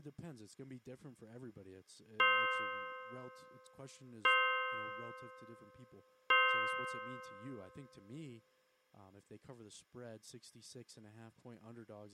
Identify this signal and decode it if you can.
Clock strike, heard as a bell, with speech in English. 3. Three o'clock.